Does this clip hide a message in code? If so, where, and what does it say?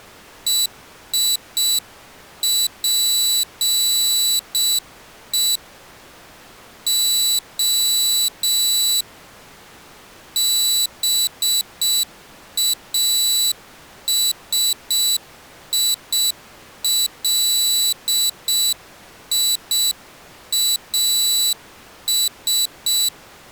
Yes: Morse code (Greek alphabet) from 0.4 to 23.1 s, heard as a high beeper, hand-sent with a straight key, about 6 wpm, 3950 Hz. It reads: ΕΙΠΕ Ο ΒΑΣΙΛΙΑΣ